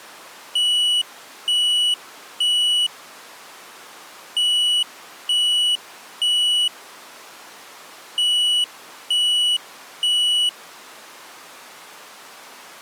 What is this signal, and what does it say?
Alarm pattern, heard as an alarm's beeps, played three times, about 2950 Hz. Temporal three. Smoke or fire, evacuate.